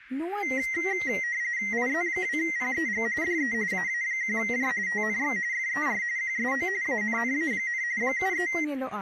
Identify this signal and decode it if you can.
RTTY (45.45 baud, 170 Hz shift), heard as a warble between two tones, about 2000 Hz centre, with speech in Santali. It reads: IZ2PEG DE AA1J TNX FER QSO ANNA, 73